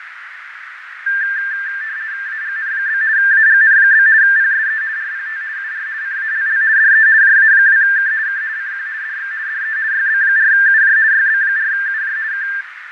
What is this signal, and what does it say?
RTTY (50 baud, 170 Hz shift), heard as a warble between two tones, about 1700 Hz centre, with radio static, fading and a narrow filter. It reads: AGN? AGN? PSE RPT UR CALL DE JA2K K CQ DX DE YB4UJ YB4UJ K